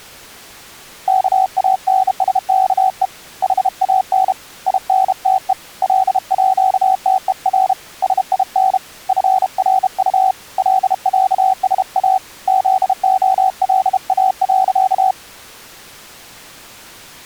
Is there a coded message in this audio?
Yes: Morse code (with Swedish letters) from 1.0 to 15.2 s, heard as a keyed tone, hand-sent with a bug key, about 32 wpm, 760 Hz. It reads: KANSKE HAN INTE LÅTER SIN FRU LÄSA ZOLA.